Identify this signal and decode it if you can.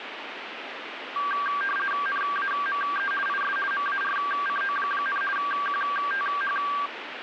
RTTY (50 baud, 450 Hz shift), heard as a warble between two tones, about 1370 Hz centre, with radio static. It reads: NAME IS MARCO, QTH